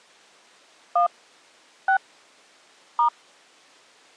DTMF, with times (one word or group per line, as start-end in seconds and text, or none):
1.0-1.1 1
1.9-2.0 6
3.0-3.1 *